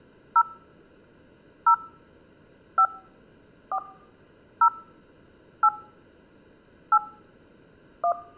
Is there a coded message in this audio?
Yes: DTMF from 0.4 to 8.1 s, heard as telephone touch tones, dialled by hand, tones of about 80 ms. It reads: 0 0 5 4 0 8 8 1